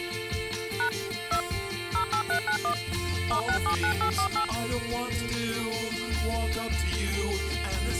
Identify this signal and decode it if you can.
DTMF, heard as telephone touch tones, dialled by machine, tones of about 90 ms. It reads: # 2 08391 *679848